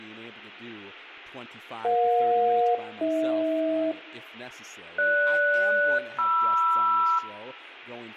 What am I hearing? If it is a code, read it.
Aircraft SELCAL, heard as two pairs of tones, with room echo and speech in English. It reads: EJ-AH GS-MR